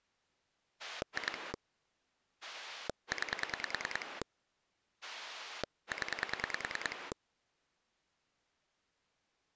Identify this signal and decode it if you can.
Pulse dialling, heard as a rotary dial, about 10 pulses a second. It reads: 2 9 0